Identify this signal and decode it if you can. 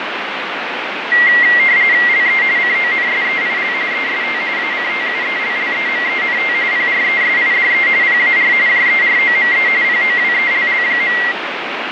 RTTY (45.45 baud, 170 Hz shift), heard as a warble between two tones, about 2000 Hz centre, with radio static and fading. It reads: LE CONSEIL EST ACTUELLEMENT PRESIDE PAR JEROME POWELL.